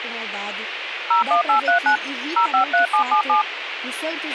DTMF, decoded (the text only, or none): 01839 053777